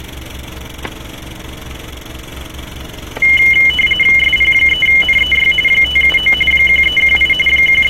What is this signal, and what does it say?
RTTY (45.45 baud, 850 Hz shift), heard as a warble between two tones, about 2550 Hz centre, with static crashes and street noise. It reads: SP3NEY 579 1318 …